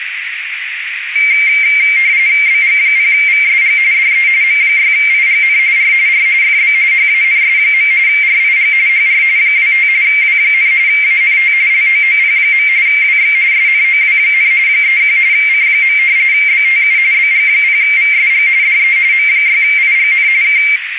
RTTY (45.45 baud, 170 Hz shift), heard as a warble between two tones, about 2200 Hz centre, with radio static and a narrow filter. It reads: BG0VSG DE M6IGN R R FB HANS. RIG HR 25 W, ANT LOOP. WX SNOW, 31 C. BTU BG0VSG DE M6IGN K